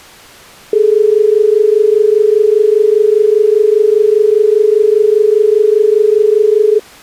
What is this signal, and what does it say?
Telephone call progress tone (as in Australia), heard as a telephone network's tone, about 430 Hz. Dial tone.